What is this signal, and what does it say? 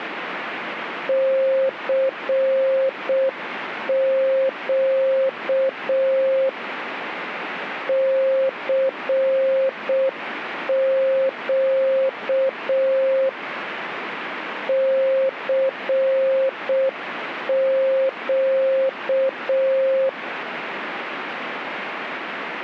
Morse code, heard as a keyed tone, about 6 wpm, 530 Hz, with radio static. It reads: CQ CQ CQ